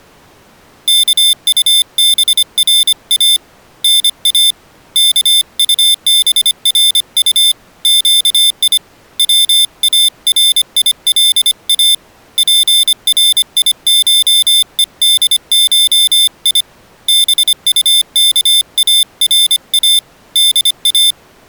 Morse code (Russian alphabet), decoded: КУБРА НА КУБРУ ЩИ ВАРИЛА ПРИШЕДШИ БУКАРА ДА

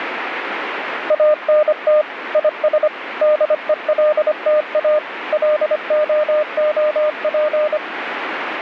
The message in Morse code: ANT IS DELTA LOOP

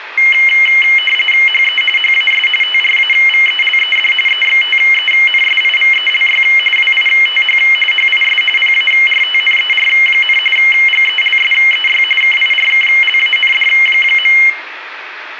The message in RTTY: HE HAS TRAVELED EXTENSIVELY WITH HIS PARTNER, GELSEY KIRKLAND.

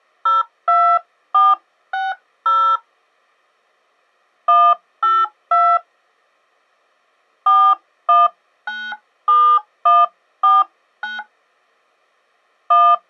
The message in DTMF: 02460 182 4197149 1

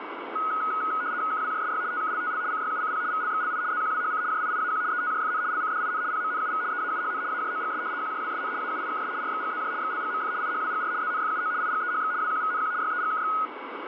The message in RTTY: KWJSY TKLTL CYUCP VLXLI ZQWHC JIIAQ ETJFN LCDIN PMNUV EAUHN AJOGS QJWSN AUIKS RXGZJ XLGMF IHWGR ZNFUO IGEHX WQVNQ YEGKX

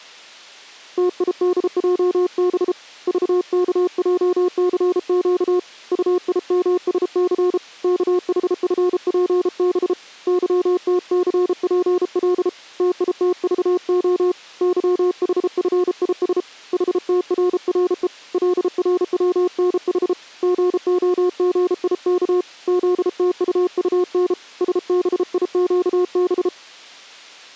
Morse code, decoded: TIDJB VKJCQ UIMSC KHFPB YTCPL TITVO YHFIS HTRRE LRWNH GOGIK ZTUUN SBIQB

